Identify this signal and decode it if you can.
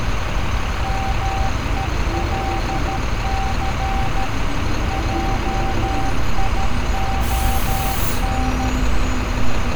Morse code, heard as a keyed tone, machine-sent, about 13 wpm, 780 Hz, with street noise. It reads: MELC JION